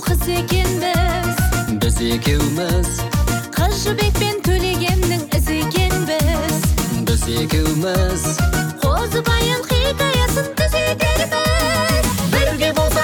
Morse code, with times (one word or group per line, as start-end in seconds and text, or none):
none